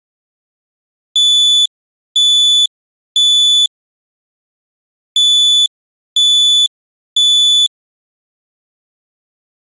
Alarm pattern, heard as an alarm's beeps, played twice, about 3450 Hz. Temporal three. Smoke or fire, evacuate.